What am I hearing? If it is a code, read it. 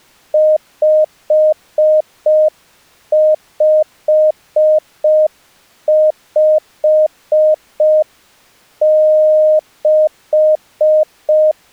Morse code, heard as a keyed tone, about 5 wpm, 620 Hz. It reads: 5556